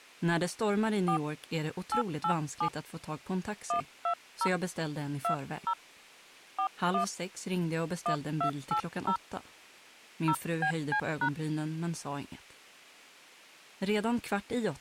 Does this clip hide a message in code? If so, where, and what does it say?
Yes: DTMF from 1.1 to 11.3 s, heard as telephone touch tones, dialled by hand, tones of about 80 ms. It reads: 4 887 120 20 41 1280 0BC#